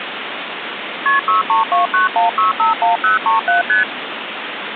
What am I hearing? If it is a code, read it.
Multi-frequency trunk signalling (R1, as on North American trunks), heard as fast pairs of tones, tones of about 140 ms, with phone line noise. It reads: KP 63291651037 ST